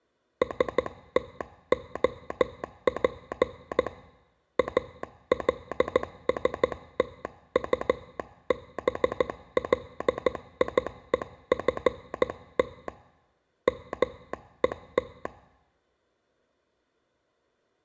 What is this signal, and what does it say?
Morse code, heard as a telegraph sounder, hand-sent with a straight key, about 14 wpm. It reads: STOP ALSTUBLIEFT MET